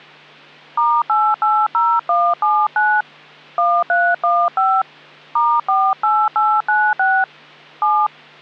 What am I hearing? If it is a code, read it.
DTMF, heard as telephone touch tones, dialled by hand, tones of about 250 ms, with hum. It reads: *880179 1315 *48896 7